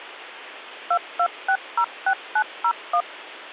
DTMF, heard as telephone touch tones, dialled by machine, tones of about 70 ms. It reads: 22606901